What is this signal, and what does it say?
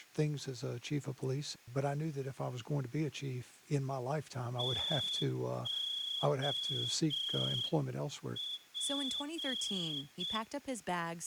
Morse code, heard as a whistle, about 7 wpm, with speech in English. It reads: TOP